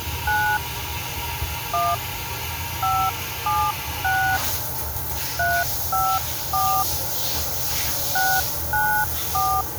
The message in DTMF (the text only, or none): 9 1 576 354 694